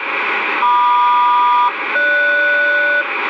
Aircraft SELCAL, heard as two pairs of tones, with radio static and room echo. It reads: MQ-GS